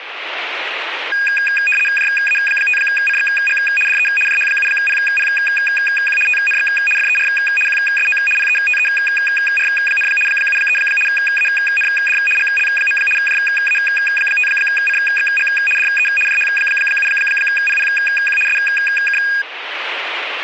RTTY (75 baud, 850 Hz shift), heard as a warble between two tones, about 2050 Hz centre, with radio static. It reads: JA5CXG DE JH7PPQ TNX FER QSO PETER, 73 AND GL. JA5CXG DE JH7PPQ SK